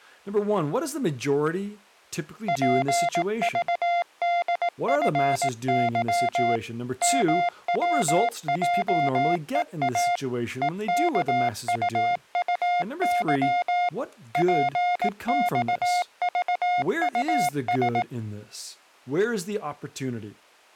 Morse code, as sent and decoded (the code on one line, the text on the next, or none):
.--. ...- -.. ..-. -.-- / -- .-- .--- . .- / . -.- ..- ..- -.-- / .--. -..- ...- ..- ...
PVDFY MWJEA EKUUY PXVUS